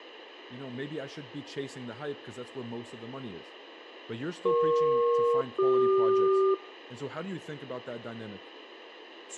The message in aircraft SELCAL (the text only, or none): EP-CQ